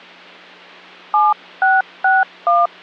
DTMF, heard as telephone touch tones, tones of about 190 ms. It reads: 7661